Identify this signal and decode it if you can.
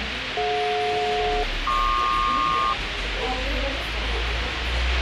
Aircraft SELCAL, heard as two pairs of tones, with radio hiss, a squelch burst at the end and the noise of a cafe. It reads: DJ-PQ